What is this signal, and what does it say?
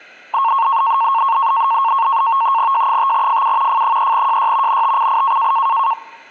NAVTEX (SITOR-B), 100 baud, 170 Hz shift, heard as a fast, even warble, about 1000 Hz centre. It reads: J5FU F3JY NTCI